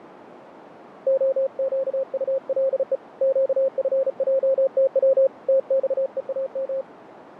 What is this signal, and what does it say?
Morse code, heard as a keyed tone, hand-sent with a bug key, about 35 wpm, 540 Hz, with radio static and fading. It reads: OQULE QFJTW TXEAM